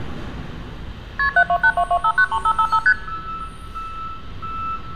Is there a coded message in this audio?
Yes: multi-frequency trunk signalling (R1, as on North American trunks) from 1.2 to 2.9 s, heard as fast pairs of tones, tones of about 70 ms, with street noise. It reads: KP 72822593555 ST